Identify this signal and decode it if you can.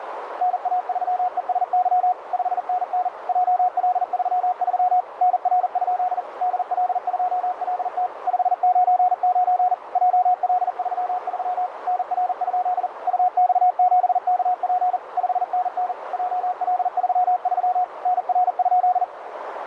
Morse code, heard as a keyed tone, machine-sent, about 40 wpm, 730 Hz, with radio static and a narrow filter. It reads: NA3ESY 5NN JL33 NR? DL2LT 599 JL33 NR? UX7KP 5NN JL33 NR?